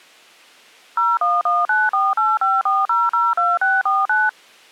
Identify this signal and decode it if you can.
DTMF, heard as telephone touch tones, dialled by machine, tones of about 200 ms. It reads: 01194854002649